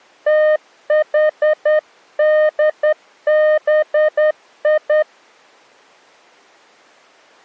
Morse code (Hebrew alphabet), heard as a keyed tone, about 10 wpm, 610 Hz. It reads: תחדבי